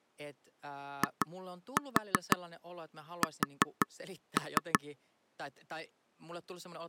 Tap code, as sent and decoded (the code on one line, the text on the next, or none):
2-4 4-3
IS